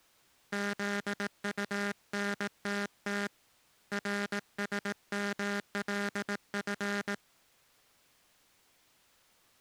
Morse code, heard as a buzzer, hand-sent with a paddle, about 18 wpm. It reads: ZUNTT RSMLF